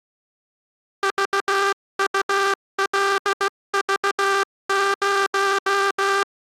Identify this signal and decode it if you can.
Morse code, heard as a buzzer, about 16 wpm. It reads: VULV0